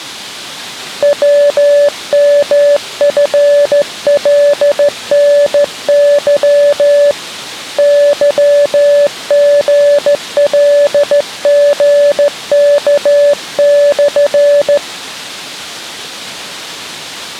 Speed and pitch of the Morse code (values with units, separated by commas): 14 wpm, 580 Hz